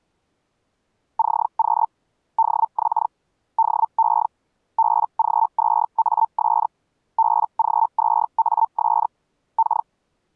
Hellschreiber (Feld-Hell, 122.5 baud), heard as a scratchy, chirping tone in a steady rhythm, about 900 Hz. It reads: CQ DX DE BG2AS BG2AS K